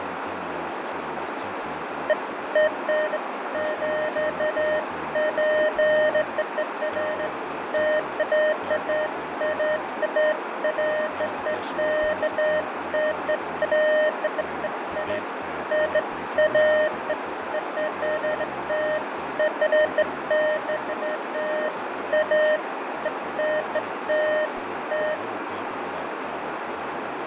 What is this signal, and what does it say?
Beeps of irregular length, with radio static, fading, a narrow filter and speech in English. There is no code.